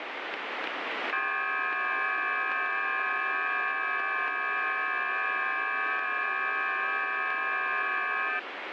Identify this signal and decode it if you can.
FT8 (several signals at once), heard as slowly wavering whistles, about 6.25 baud, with radio static.